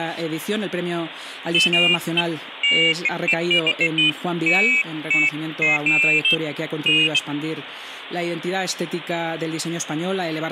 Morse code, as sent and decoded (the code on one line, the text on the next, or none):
none